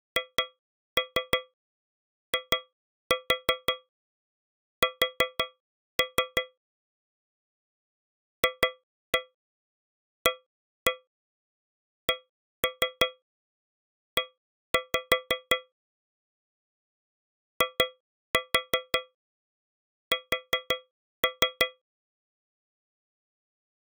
Tap code, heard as taps on a metal pipe, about 5 knocks a second. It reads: HIS FACE IS